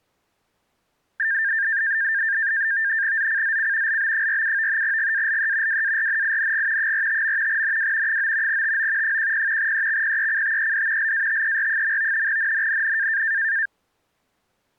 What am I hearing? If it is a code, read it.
NAVTEX (SITOR-B), 100 baud, 170 Hz shift, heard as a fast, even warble, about 1700 Hz centre. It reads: ZCZC LB47 GALE WARNING 45. NW 9 TO 10 EXPECTED LATER. NNNN